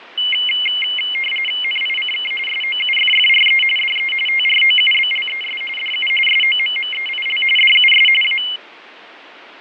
RTTY (45.45 baud, 850 Hz shift), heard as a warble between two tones, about 2550 Hz centre, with radio static and fading. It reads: NICK SOUFFRE DE TROUBLES DU SOMMEIL DUS A